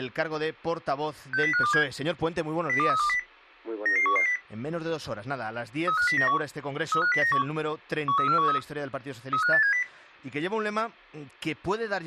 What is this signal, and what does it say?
Five-tone selective call (CCIR), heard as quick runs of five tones, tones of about 100 ms. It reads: 60527 02320 99110 35091 35091 13413 35870